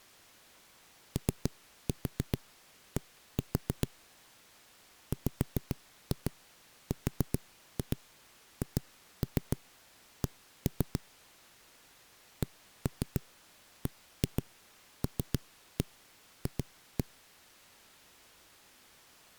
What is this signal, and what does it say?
Tap code, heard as knocks on a wall, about 7 knocks a second. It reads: OD WRHC CBLF